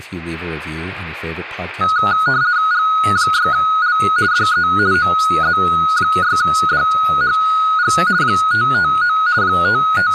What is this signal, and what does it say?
RTTY (50 baud, 170 Hz shift), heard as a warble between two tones, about 1360 Hz centre, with static crashes, room echo and speech in English. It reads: G6L DE OZ6DHG 559 …